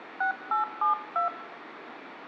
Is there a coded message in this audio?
Yes: DTMF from 0.2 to 1.3 s, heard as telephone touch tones, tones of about 110 ms, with phone line noise and room echo. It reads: 6872